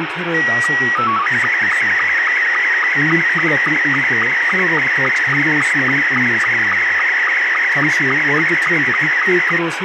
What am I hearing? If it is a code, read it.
SSTV (slow-scan television), Scottie S2, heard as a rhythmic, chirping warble, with radio static and speech in Korean.